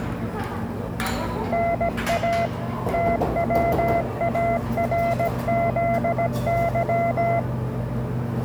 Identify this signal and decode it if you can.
Morse code, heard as a keyed tone, machine-sent, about 17 wpm, 680 Hz, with the noise of a cafe. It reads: NA TWARZY